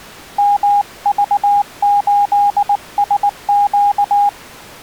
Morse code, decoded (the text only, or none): MV8SQ